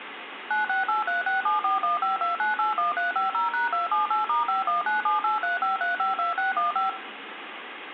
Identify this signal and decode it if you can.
DTMF, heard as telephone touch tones, dialled by machine, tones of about 140 ms, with phone line noise and room echo. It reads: 9683674152981350#278*5197835352615